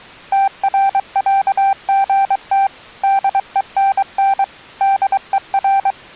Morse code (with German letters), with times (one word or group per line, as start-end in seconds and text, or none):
0.3-2.7 TRÄGT
3.0-4.4 DENN
4.8-5.9 DER